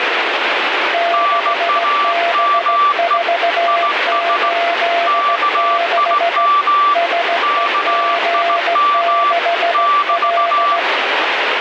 Morse code, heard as two keyed tones, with radio static. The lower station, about 16 wpm, 680 Hz: 6B486 SEG6L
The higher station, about 17 wpm, 1160 Hz: NAME IS KIM KIM <BT>